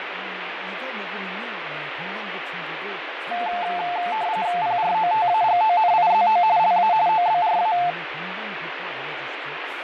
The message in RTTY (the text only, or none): PROTAGONIZO LA OBRA